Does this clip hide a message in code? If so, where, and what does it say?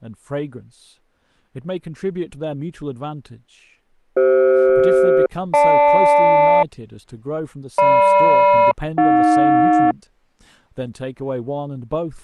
Yes: aircraft SELCAL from 4.2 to 9.9 s, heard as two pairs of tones, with speech in English. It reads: CF-GL GM-AJ